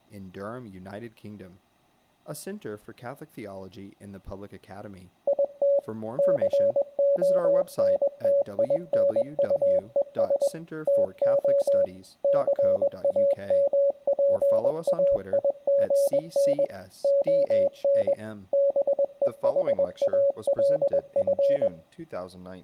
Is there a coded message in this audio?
Yes: Morse code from 5.2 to 21.7 s, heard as a keyed tone, machine-sent, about 21 wpm, 560 Hz, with speech in English. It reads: IT CONTINUES TO CAMPAIGN ON BEHALF